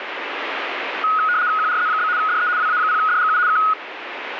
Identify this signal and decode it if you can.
RTTY (75 baud, 170 Hz shift), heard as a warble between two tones, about 1360 Hz centre, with radio static. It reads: QRZ? DE WA0DGU K